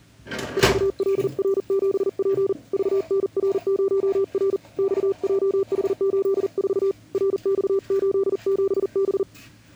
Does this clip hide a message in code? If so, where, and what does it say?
Yes: Morse code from 0.5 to 9.3 s, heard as a keyed tone, hand-sent with a paddle, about 40 wpm, 390 Hz, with kitchen noise. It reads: 4LR7P VNR0R XJH84 RX87B